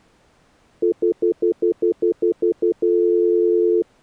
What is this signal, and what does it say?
Telephone call progress tone (North American plan), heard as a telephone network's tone, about 350, 440 Hz, 0.1 s on and 0.1 s off. Stutter dial tone.